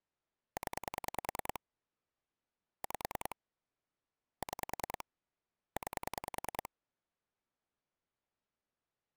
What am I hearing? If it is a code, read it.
Pulse dialling, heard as clicks on a phone line, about 10 pulses a second. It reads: 0 5 6 9